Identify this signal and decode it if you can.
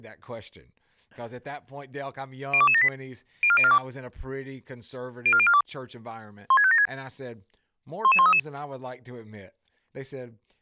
Five-tone selective call (ZVEI), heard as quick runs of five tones, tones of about 70 ms, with speech in English. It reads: 02278 04042 04042 16576 11133